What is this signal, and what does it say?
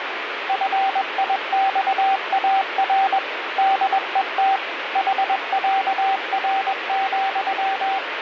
Morse code (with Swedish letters), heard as a keyed tone, machine-sent, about 21 wpm, 780 Hz, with radio static. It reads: FIXAR DET HÄR,